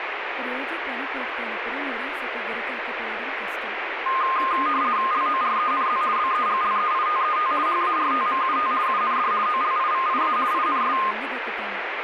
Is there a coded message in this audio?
Yes: RTTY (50 baud, 170 Hz shift) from 4.1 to 11.1 s, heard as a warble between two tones, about 1140 Hz centre, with radio static and speech in Telugu. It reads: LORENZ BEGLEITET HARTMUT UND OLIVIA INS